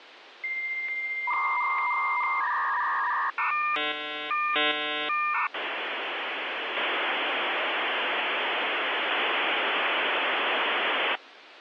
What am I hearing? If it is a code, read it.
Dial-up modem handshake (V.34 or later), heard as a whistle, warbles, then hiss, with phone line noise.